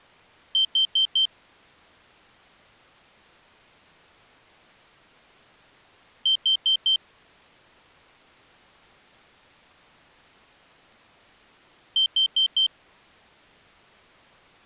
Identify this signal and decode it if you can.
Alarm pattern, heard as an alarm's beeps, played three times, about 3100 Hz. Temporal four. Carbon monoxide.